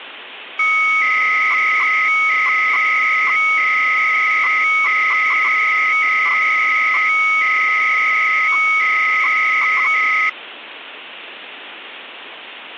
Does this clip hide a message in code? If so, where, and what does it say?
Yes: 300-baud modem data (Bell 103 tones) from 0.6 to 10.3 s, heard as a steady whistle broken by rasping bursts, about 300 baud, 200 Hz shift, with phone line noise.